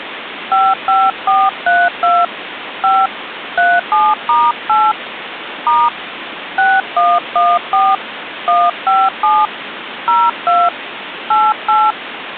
DTMF, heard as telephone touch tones, dialled by hand, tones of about 220 ms, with phone line noise. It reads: 55432 5 37*8 * 6114 157 02 88